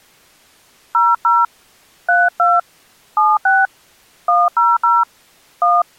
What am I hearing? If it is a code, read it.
DTMF, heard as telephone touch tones, dialled by hand, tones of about 200 ms. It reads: 00 32 76 100 1